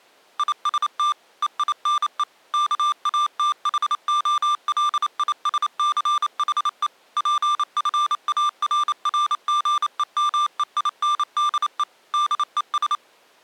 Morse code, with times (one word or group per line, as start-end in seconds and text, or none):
0.4-1.1 IST
1.4-2.2 EINE
2.5-6.9 KATHOLISCHE
7.2-11.8 PFARRGEMEINDE
12.1-12.9 DES